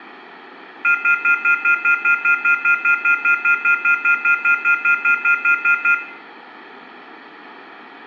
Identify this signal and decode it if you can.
Telephone call progress tone (North American plan), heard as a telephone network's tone, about 1400, 2050, 2450, 2600 Hz, 0.1 s on and 0.1 s off, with room echo. Off-hook warning tone.